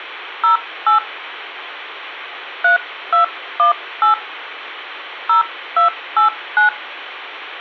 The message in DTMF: 08 3218 0289

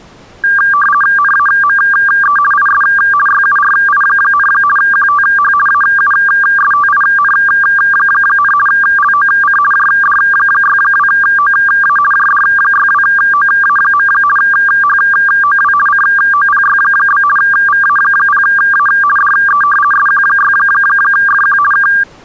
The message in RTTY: NAME IS YURI, QTH AUSTIN, LOC JD62OA JD62OA. HOW COPY? VA0A DE SQ6FQ K

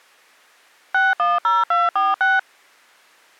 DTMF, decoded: 610246

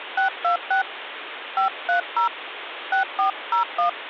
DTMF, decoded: 626 530 6401

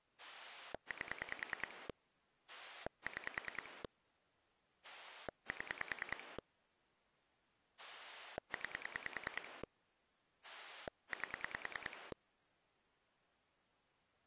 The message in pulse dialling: 8 6 7 9 8

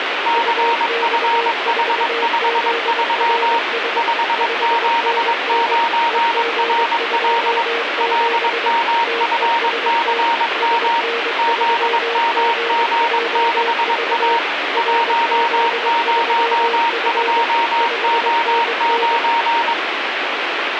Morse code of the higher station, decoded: CFH53 579RL LMFCM ZMG6A 102O9

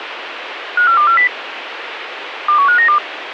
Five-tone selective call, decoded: 54240 21592

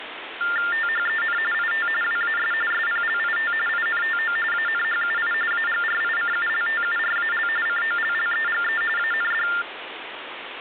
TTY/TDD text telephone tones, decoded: THEN IT WAS SPLIT INTO ANHUI AGRICULTURAL COLLEGE AND

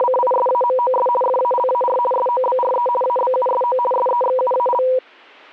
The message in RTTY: … FALAR SOBRE ABUSO SEXUAL

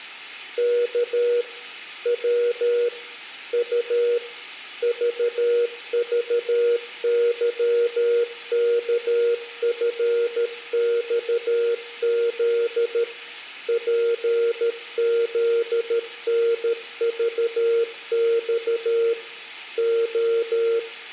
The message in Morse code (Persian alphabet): ک و ط ذذظکفخز پزنذخ ع

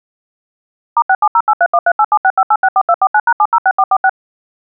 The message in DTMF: *67083138765864249#706446

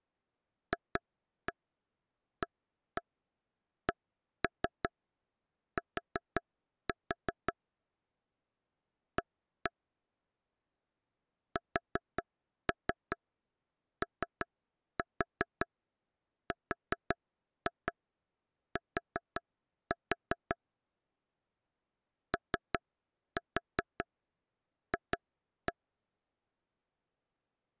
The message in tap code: FACT A SORT OF

